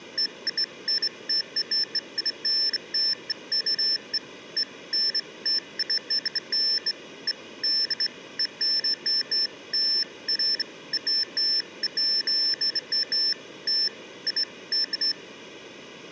Beeps of irregular length, with room echo. There is no code.